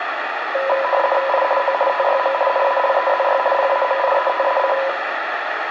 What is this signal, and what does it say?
RTTY (50 baud, 450 Hz shift), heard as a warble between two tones, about 770 Hz centre, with radio static and room echo. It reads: I O TYM NALEZY PAMIETAC